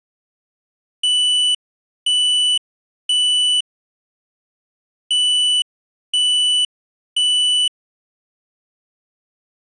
Alarm pattern, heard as an alarm's beeps, played twice, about 3000 Hz. Temporal three. Smoke or fire, evacuate.